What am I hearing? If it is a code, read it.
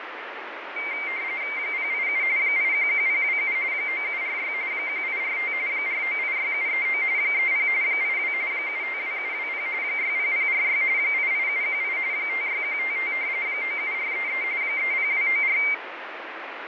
RTTY (45.45 baud, 170 Hz shift), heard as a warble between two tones, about 2200 Hz centre, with radio static. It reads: 087 811027 9746 1845 4986739 30 82 752720 60046 88718 56155 97433 30294